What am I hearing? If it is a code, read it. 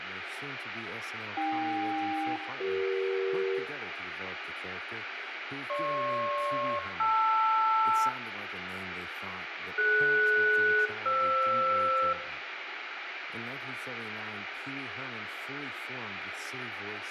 Aircraft SELCAL, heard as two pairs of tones, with radio hiss, room echo and speech in English. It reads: AK-CE GP-LR DS-FR